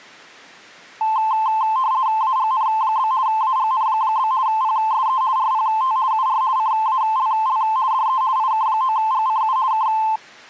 RTTY (50 baud, 170 Hz shift), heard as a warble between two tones, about 960 Hz centre. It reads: AGN? AGN? PSE RPT UR CALL DE IK9GCU K